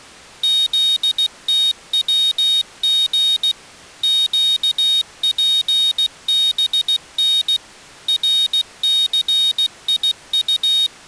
Morse code, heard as a high beeper, machine-sent, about 16 wpm, 3750 Hz. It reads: ZTWG QPBN RCIU